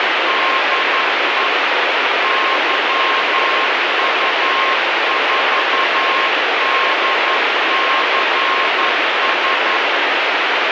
Morse code, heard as a keyed tone, machine-sent, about 11 wpm, 1070 Hz, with heavy radio static. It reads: DE YU4DCS